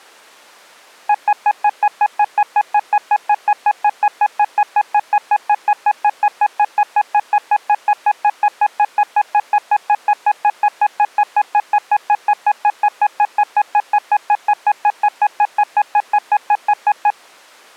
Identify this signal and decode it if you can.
Evenly repeated beeps. There is no code.